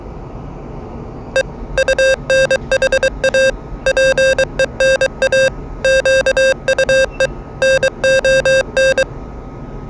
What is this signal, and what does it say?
Morse code, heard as electronic beeps, machine-sent, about 23 wpm, 530 Hz, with the noise inside a lift. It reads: E UNHA PENA QUE NON